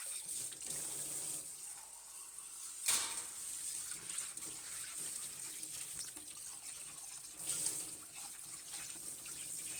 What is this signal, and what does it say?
Kitchen noise. There is no code.